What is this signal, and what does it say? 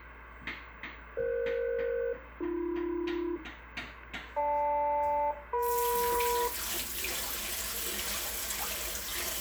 Aircraft SELCAL, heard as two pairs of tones, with room echo and kitchen noise. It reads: EF-AB GL-EM